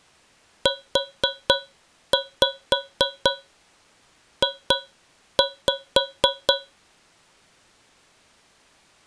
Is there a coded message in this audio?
Yes: tap code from 0.7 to 6.7 s, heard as taps on a metal pipe, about 4 knocks a second. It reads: UJ